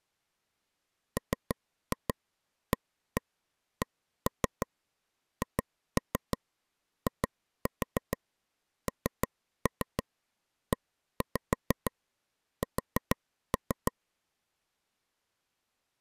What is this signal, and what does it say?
Tap code, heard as taps on a table, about 6 knocks a second. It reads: MACHINES